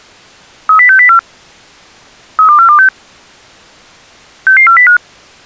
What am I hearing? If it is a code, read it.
Five-tone selective call (CCIR), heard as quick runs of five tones, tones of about 100 ms. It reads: 30604 32426 66405